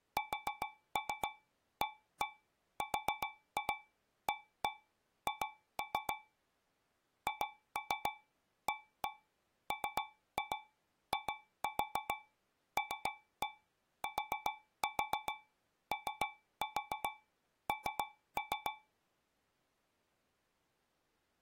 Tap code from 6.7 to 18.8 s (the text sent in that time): HAMILTON